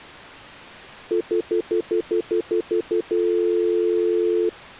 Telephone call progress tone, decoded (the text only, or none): stutter dial tone